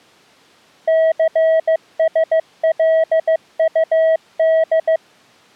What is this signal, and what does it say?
Morse code, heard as a keyed tone, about 15 wpm, 640 Hz. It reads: CSLUD